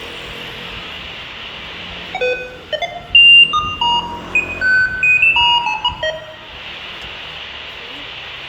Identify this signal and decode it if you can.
Electronic bleeps of random pitch and length, with room echo and street noise. There is no code.